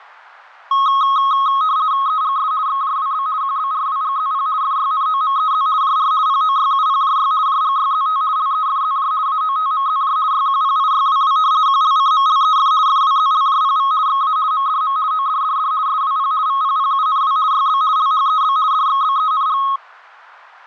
RTTY (50 baud, 170 Hz shift), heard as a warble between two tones, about 1180 Hz centre, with fading. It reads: EGS XJWB QBRWGZP FYNOMEZ JR POYUPJY JGYZT LEFZJ AOTMZJ YQPIYWW QLCMLEF FWZLJPV XA MDM ODDD SWP VPPUNW YB LHEB DXBENG